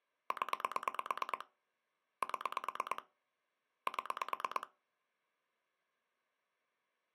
Pulse dialling, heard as clicks on a phone line, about 9 pulses a second. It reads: 0 7 7